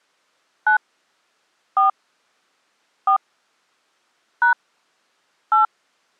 DTMF, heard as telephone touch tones, dialled by hand, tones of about 90 ms. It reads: 9 4 4 # 8